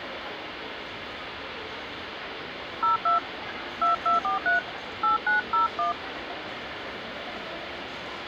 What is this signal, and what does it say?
DTMF, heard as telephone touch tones, dialled by hand, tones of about 130 ms, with radio hiss, a squelch burst at the end and the noise of a crowd indoors. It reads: 02 2243 8901